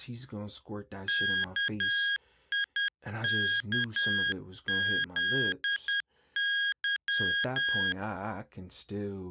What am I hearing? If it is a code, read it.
Morse code, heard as electronic beeps, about 10 wpm, 1650 Hz, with speech in English. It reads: KIKZY